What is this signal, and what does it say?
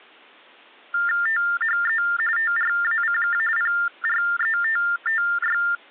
TTY/TDD text telephone tones (45.45 baud Baudot), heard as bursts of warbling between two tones, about 400 Hz shift, 1600 Hz centre. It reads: THE TRACK PRETTY